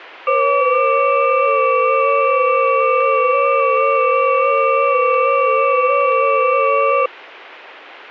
FT8 (several signals at once), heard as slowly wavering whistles, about 6.25 baud, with radio static.